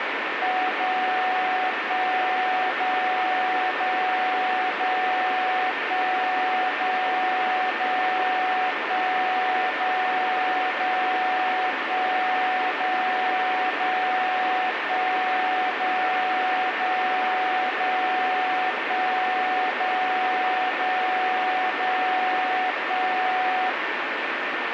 Radio time signal (DCF77), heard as a tone whose level steps once a second, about 740 Hz, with radio static and a steady whistle near 1800 Hz. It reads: 0 1 0 0 0 1 0 0 1 0 0 1 0 0 1 0 0 0 1 0 0 0 1